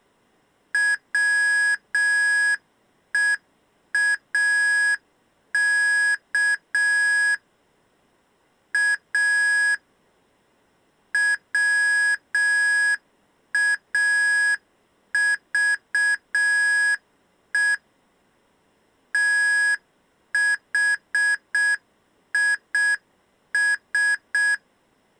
Morse code, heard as electronic beeps, machine-sent, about 6 wpm, 1650 Hz. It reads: WEAK A WAVE THIS